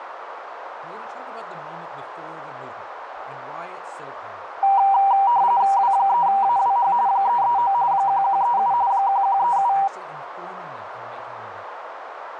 RTTY (45.45 baud, 170 Hz shift), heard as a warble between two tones, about 870 Hz centre, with radio static, a narrow filter and speech in English. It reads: W3AWH 339 1137 1137